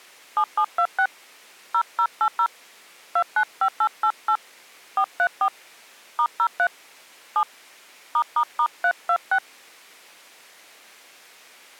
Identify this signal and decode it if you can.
DTMF, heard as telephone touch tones, dialled by hand, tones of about 70 ms. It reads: 7726 0080 295888 434 *03 7 ***326